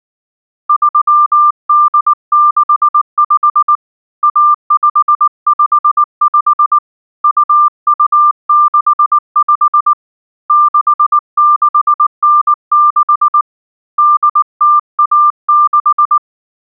Morse code (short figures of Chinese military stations), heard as a keyed tone, hand-sent with a paddle, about 19 wpm, 1190 Hz. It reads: 3865 1555 2265 6696 8016